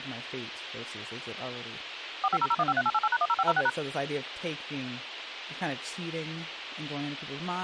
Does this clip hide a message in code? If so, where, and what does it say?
Yes: DTMF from 2.2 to 3.7 s, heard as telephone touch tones, dialled by machine, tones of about 50 ms, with radio hiss and speech in English. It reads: 4500153888#10506#